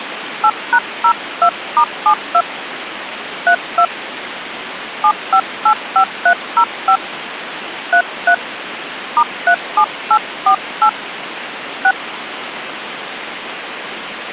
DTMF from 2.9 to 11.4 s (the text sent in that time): 32 7585305 33 *37848